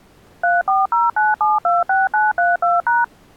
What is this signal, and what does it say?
DTMF, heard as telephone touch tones, dialled by machine, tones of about 180 ms. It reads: 3409726932#